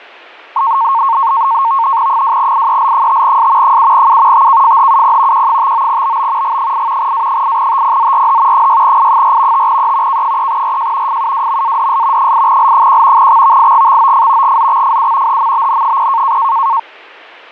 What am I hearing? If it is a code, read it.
NAVTEX (SITOR-B), 100 baud, 170 Hz shift, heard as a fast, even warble, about 1000 Hz centre. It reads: 2IEL5S 7U TKFHUP Q59BB G8 A8TPZRH 6I4 5E K3RJ FUWMADS 8L1 XVIGXOF GZXFU HMBN0